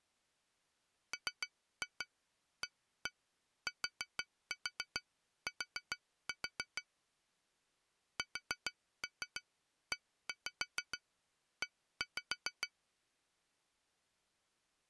Tap code, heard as taps on glass, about 6 knocks a second. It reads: MATT SEE